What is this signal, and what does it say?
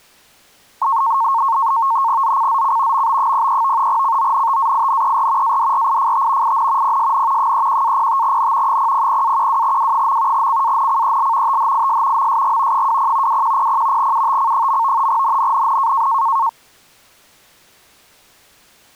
NAVTEX (SITOR-B), 100 baud, 170 Hz shift, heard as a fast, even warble, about 1000 Hz centre. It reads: ZCZC MB03 CONTAINER ADRIFT IN PSN 31-05N 000-12W. CANCEL THIS MSG 20 2100 UTC. NNNN